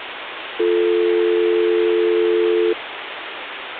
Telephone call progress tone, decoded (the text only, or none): dial tone